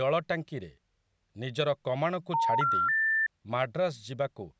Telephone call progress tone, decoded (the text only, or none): special information tone